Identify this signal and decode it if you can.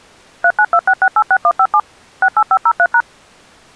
DTMF, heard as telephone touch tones, dialled by machine, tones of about 60 ms. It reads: 3926686157 68503#